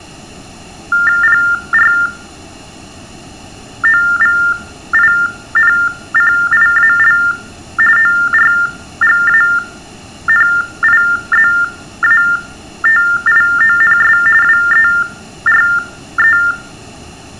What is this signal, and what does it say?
TTY/TDD text telephone tones (45.45 baud Baudot), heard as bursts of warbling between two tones, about 400 Hz shift, 1600 Hz centre, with room echo. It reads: PROVINCIAL ORGANIZATIONS WERE